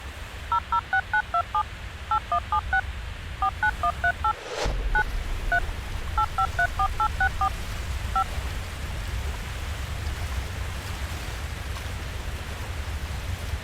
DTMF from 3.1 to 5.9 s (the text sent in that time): 49138 9 3